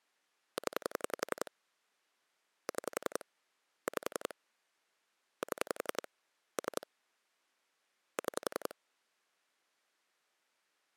Pulse dialling, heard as clicks on a phone line, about 11 pulses a second. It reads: 0 6 5 7 3 6